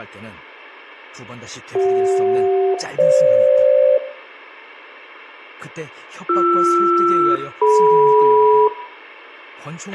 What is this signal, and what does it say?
Aircraft SELCAL, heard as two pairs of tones, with a squelch burst at the end, room echo and speech in Korean. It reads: CJ-FG BR-DM